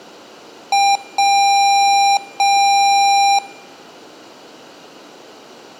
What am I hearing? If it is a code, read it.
Beep code, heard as beeps from a small speaker, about 800 Hz. 1 short, 2 long.